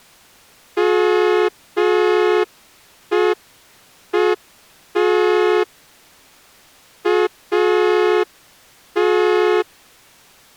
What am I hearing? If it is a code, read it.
Morse code, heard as a horn, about 5 wpm. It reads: MEET AT